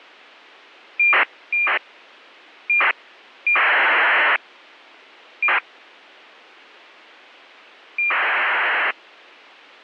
ACARS aircraft data, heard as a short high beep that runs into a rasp, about 2400 baud.